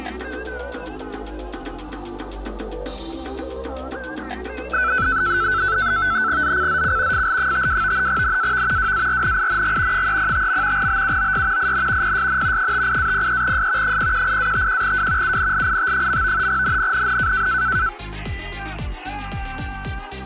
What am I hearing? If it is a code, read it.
NAVTEX (SITOR-B), 100 baud, 170 Hz shift, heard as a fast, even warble, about 1420 Hz centre. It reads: ZCZC FL52 NAV WARNING 305. BUOY IN PSN 58-03S 018-51W UNLIT. NNNN